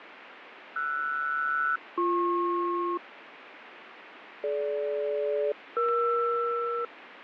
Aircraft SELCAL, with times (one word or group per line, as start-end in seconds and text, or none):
0.8-3.0 RS-BP
4.4-6.8 DG-ER